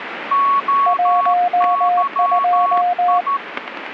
Morse code, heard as two keyed tones, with radio static and static crashes. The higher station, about 13 wpm, 1110 Hz: OYI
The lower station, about 19 wpm, 710 Hz: 12